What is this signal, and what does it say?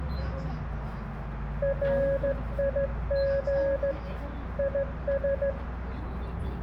Morse code, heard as a keyed tone, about 14 wpm, 550 Hz, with radio static, room echo and the noise inside a bus. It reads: RIG IS